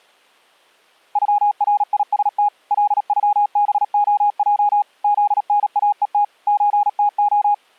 Morse code (Russian alphabet), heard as a keyed tone, machine-sent, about 37 wpm, 820 Hz. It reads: ЮРИСТ ЛЮБОЙ ЗНАЕТ ЧТО